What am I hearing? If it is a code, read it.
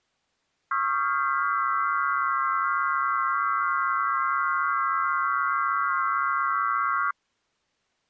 FT8 (several signals at once), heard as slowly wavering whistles, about 6.25 baud.